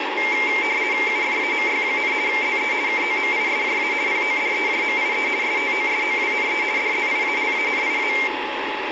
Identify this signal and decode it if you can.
RTTY (50 baud, 170 Hz shift), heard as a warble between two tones, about 2200 Hz centre, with radio static and a steady whistle near 850 Hz. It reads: UFAMY, ZE KOMISJA PODEJMIE STOSOWNE DZIALANIA